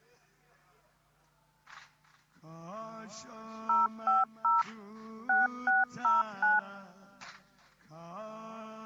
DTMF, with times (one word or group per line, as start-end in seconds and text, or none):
3.7-4.6 050
5.3-6.6 6609